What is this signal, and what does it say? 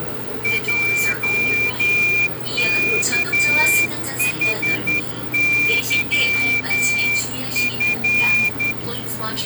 Morse code, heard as a whistle, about 11 wpm, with the noise inside a subway train. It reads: JKHYF